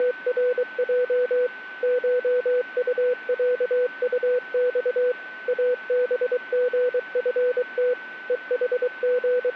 Morse code (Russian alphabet), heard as a keyed tone, machine-sent, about 23 wpm, 500 Hz, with a steady whistle near 1520 Hz. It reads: … ШУЯУЬ АБГФТ …